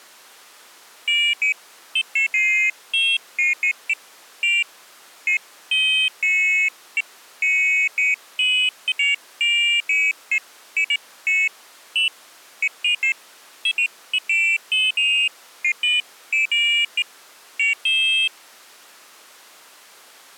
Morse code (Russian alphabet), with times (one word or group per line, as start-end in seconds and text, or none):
none